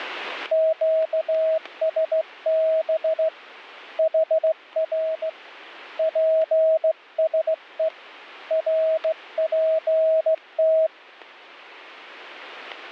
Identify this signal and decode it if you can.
Morse code, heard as a keyed tone, hand-sent with a straight key, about 16 wpm, 640 Hz, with static crashes. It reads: QSB HR PSE RPT